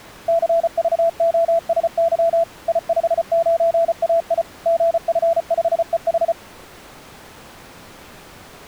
Morse code, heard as a keyed tone, machine-sent, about 34 wpm, 670 Hz. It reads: CVOSY I59AI GF5EH